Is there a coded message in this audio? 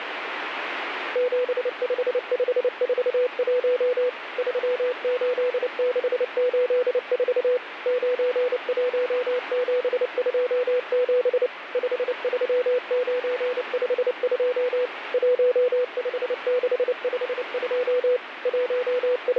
Yes: Morse code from 1.1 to 19.4 s, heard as a keyed tone, machine-sent, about 29 wpm, 500 Hz, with radio static. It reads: 75541 38684 91727 53952 15652 …